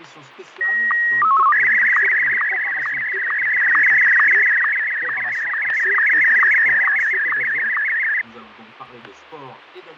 SSTV (slow-scan television), Martin M1, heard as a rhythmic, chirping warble, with fading and static crashes.